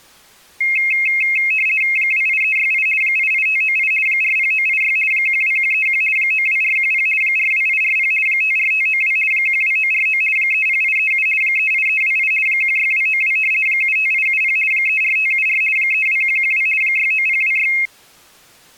RTTY (50 baud, 450 Hz shift), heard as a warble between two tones, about 2350 Hz centre. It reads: 28368 88598 40986 12131 92410 42840 54592 12949 30837 38328 16292 75870 34574 32112 69026